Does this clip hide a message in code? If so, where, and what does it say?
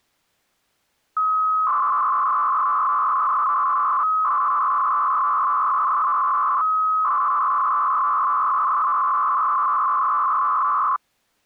Yes: 300-baud modem data (Bell 103 tones) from 1.2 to 11.0 s, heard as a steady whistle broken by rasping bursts, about 300 baud, 200 Hz shift.